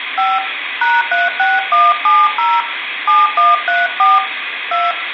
DTMF, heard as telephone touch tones, dialled by hand, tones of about 190 ms, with phone line noise and room echo. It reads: 5 #36170 7134 2